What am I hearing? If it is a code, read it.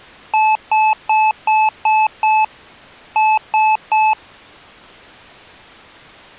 Beep code, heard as beeps from a small speaker, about 870 Hz. 6-3.